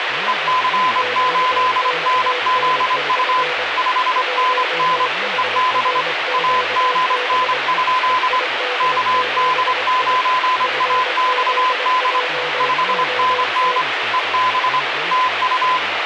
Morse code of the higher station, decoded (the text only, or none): EC8NZU 5NN EB AGN? KD9AXD 5NN EB TU